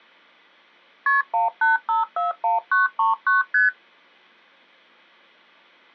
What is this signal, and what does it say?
Multi-frequency trunk signalling (R1, as on North American trunks), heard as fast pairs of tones, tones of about 150 ms. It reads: KP 18541939 ST